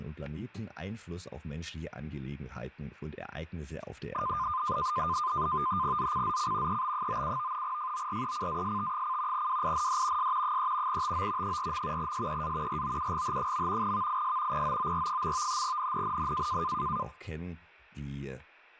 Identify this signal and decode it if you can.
NAVTEX (SITOR-B), 100 baud, 170 Hz shift, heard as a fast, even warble, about 1120 Hz centre, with static crashes and speech in German. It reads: ZCZC EB97 FORECAST: WIND S 3 TO 4. SEA ROUGH. VIS POOR. NNNN